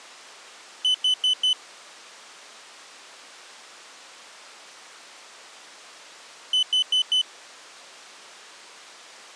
Alarm pattern, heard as an alarm's beeps, played twice, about 3000 Hz. Temporal four. Carbon monoxide.